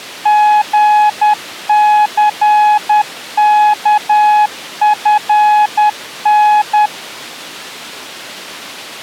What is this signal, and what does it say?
Morse code, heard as a keyed tone, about 10 wpm, 840 Hz. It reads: GCKFN